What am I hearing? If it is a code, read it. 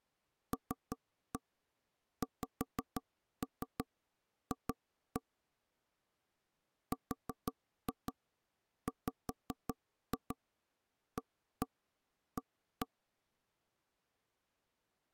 Tap code, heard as taps on a table, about 5 knocks a second. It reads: LXF RWAA